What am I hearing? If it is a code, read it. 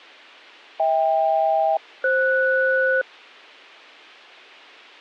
Aircraft SELCAL, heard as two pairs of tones. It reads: HK-FS